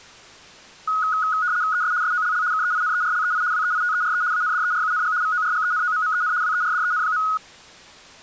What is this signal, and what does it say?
RTTY (75 baud, 170 Hz shift), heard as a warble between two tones, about 1360 Hz centre. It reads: ES SOLL KEINERLEI WEITERE ANDERUNG VORGENOMMEN WERDEN.